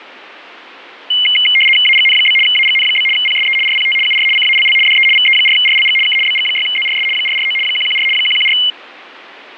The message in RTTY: AGN? AGN? PSE RPT UR CALL DE VE4RLG K BG6ZRS 449 114 114

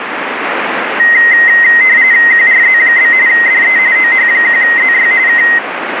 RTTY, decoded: QRZ? DE OH1ZY K

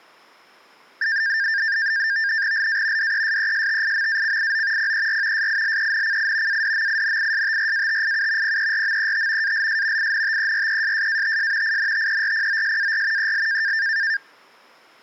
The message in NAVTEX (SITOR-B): LA DESESTIMACIO PER SILENCI ADMINISTRATIU PERMET ALS INTERESSATS INTERPOSAR EL

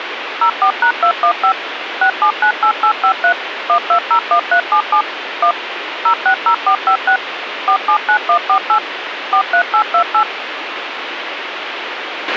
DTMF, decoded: 04#215 6798853 1201377 1 060456 479148 43828

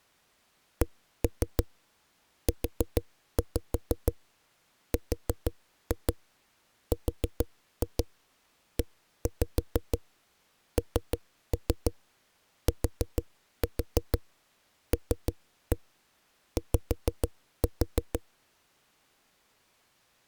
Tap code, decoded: CURRENTLY

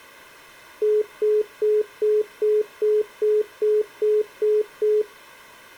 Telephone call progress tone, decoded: congestion tone

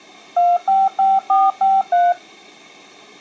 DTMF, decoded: 255453

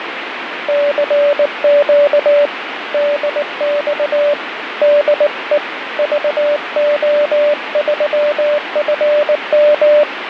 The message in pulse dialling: none

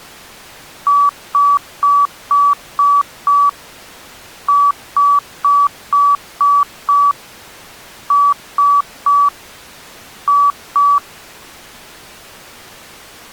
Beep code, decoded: 6-6-3-2

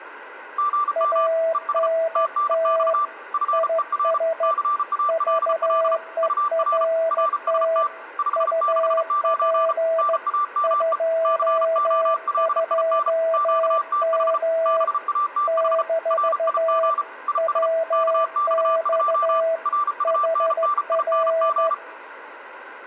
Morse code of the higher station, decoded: GM ES TNX FER CALL UR RST 569 NAME COLIN QTH BATH RIG IS KX2 RUNNING

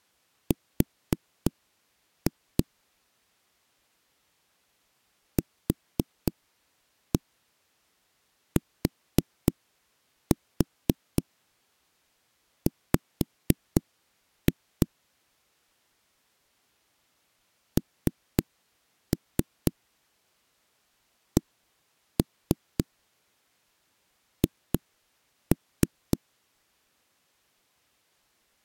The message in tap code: R QTW NCH

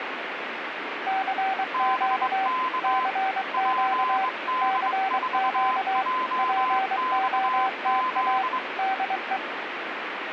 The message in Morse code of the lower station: CQ CQ CQ POTA DE

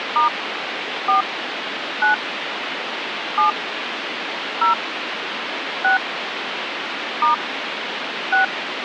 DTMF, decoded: * 4 9 7 0 6 * 6

